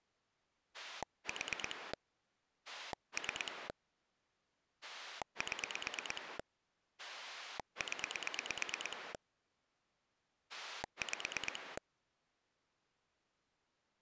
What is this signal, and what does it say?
Pulse dialling, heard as a rotary dial, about 9 pulses a second. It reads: 4 3 7 0 5